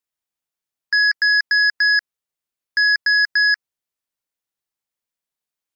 Beep code, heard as beeps from a small speaker, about 1700 Hz. 4-3.